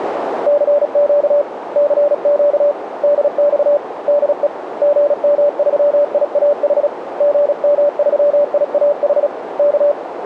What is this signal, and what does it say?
Morse code, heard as a keyed tone, hand-sent with a paddle, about 36 wpm, 580 Hz, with radio static and a narrow filter. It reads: CQ CQ DX DE GM3IAH GM3IAH K